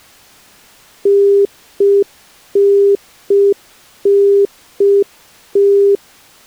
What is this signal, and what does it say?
Telephone call progress tone (UK plan), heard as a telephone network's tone, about 400 Hz. Congestion tone.